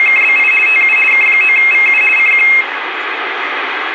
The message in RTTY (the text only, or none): … TU K9VU CQ